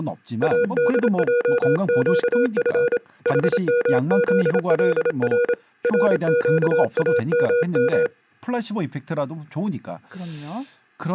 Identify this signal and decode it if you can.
Morse code, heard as a keyed tone, hand-sent with a paddle, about 27 wpm, 480 Hz, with speech in Korean. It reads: ADJQF HMZLR RQAMM